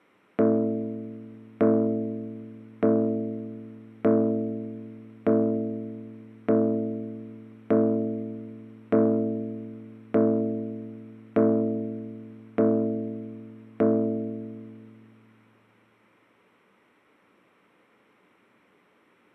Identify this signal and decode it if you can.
Clock strike, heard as a bell. 12. Twelve o'clock.